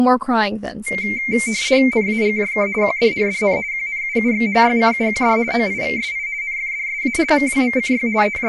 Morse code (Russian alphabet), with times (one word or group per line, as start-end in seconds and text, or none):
none